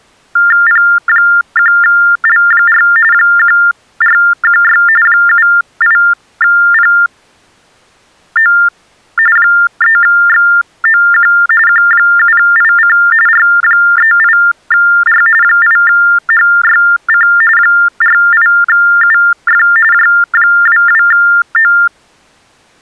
TTY/TDD text telephone tones (45.45 baud Baudot), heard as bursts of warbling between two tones, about 400 Hz shift, 1600 Hz centre. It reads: P1L4 1416 78PO 3XOQ Q7IC R38R 8HYC 48UF J22O